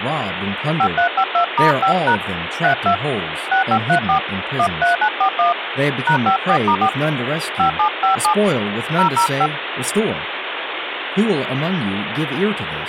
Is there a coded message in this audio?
Yes: DTMF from 0.8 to 9.5 s, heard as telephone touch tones, dialled by hand, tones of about 100 ms, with phone line noise and speech in English. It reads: 5352*5# 32 6534 13941 #54*4 5757 005